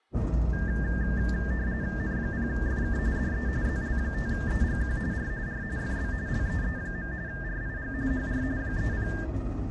RTTY (45.45 baud, 170 Hz shift), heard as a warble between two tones, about 1700 Hz centre, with the noise inside a bus. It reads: N0FK DE ZL5EGQ R R FB LEE. RIG HR 30